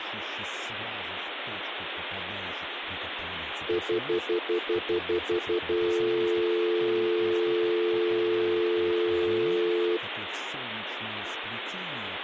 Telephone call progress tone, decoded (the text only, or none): stutter dial tone